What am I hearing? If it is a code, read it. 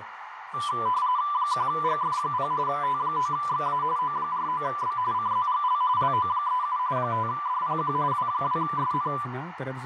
RTTY (45.45 baud, 170 Hz shift), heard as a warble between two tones, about 1090 Hz centre, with radio static, a narrow filter and speech in Dutch. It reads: 1GF0 T9XA O49B CZGL LO37 5DPQ W2SN